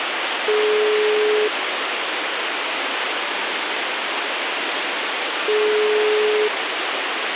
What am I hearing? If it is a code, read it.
Telephone call progress tone (single-tone plan, as in most of Europe), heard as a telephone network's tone, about 420 Hz, 1 s on and 4 s off, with phone line noise. Ringback tone.